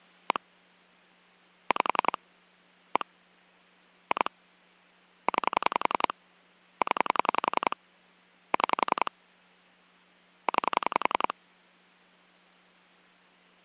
Pulse dialling, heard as clicks on a phone line, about 11 pulses a second. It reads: 1 5 1 2 9 0 6 9